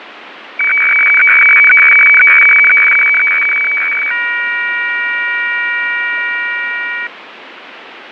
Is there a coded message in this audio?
Yes: weather fax (radiofax), 120 lines a minute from 0.6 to 7.1 s, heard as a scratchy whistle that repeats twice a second, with radio static and fading.